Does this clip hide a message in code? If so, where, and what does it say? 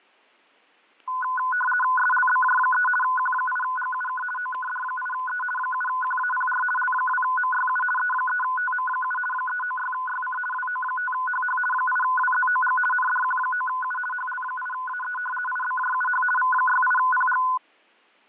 Yes: RTTY (50 baud, 450 Hz shift) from 1.1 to 17.6 s, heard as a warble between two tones, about 1250 Hz centre, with fading and static crashes. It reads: SLBJ3 Q8GUK OKD8E 7QAPR L2MYU E3TM7 396YC WO5HH 8WZOG NDQ9U HL8AE IBJUH V68PG